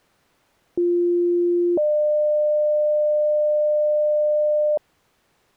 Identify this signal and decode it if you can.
Two-tone page, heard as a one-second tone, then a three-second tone, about 350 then 600 Hz.